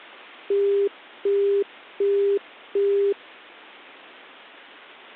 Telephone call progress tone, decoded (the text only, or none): busy tone